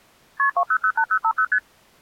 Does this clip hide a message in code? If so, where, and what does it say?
Yes: multi-frequency trunk signalling (R1, as on North American trunks) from 0.4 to 1.6 s, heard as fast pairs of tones, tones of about 70 ms. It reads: KP 2008050 ST